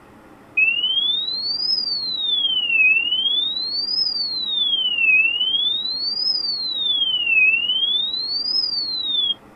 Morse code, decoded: none

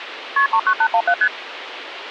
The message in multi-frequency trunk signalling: KP 39817 ST

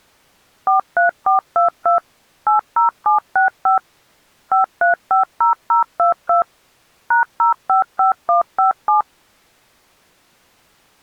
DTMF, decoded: 43422 80765 5350022 #055157

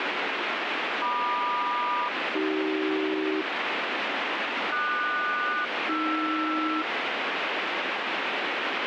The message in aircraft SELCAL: MQ-AC QS-AR

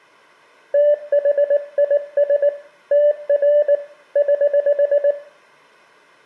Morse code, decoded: THIS TR <HH>

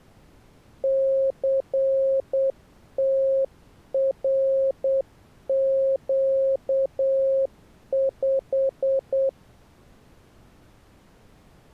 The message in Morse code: CTRQ5

